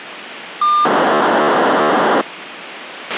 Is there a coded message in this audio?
Yes: POCSAG pager data (2400 baud) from 0.6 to 2.2 s, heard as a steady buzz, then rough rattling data, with radio hiss and a squelch burst at the end.